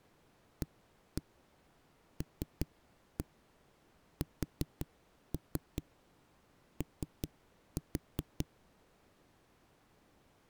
Tap code, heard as knocks on a wall, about 5 knocks a second. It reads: ALSO